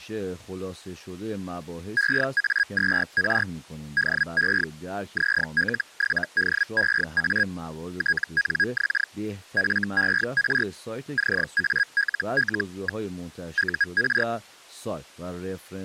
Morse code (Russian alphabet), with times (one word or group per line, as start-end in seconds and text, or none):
none